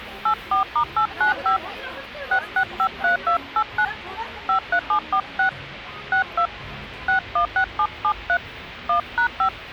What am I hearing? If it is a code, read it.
DTMF, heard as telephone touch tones, dialled by hand, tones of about 90 ms, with street noise. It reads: 84*895 6653289 53746 62 616773 1#5